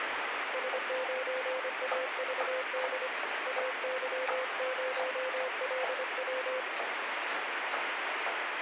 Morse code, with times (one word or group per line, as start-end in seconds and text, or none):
0.5-3.1 S9AVD
3.5-6.6 AY0LW